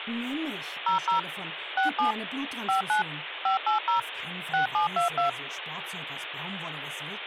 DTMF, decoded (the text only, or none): 00 67 59 580 6722